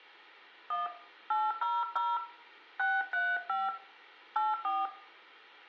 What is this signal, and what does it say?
DTMF, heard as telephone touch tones, dialled by hand, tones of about 200 ms, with room echo. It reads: 1 800 635 84